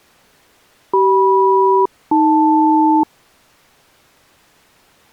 Aircraft SELCAL, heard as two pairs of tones. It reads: CM-AL